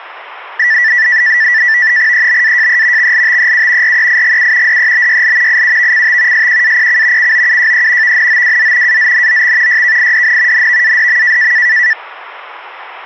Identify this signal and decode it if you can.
NAVTEX (SITOR-B), 100 baud, 170 Hz shift, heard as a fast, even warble, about 1850 Hz centre. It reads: EBAJE XLTEU REIGU DEBYL IUVCT SQAPC COUJE VNOWZ AZNOX YKIDN NVADM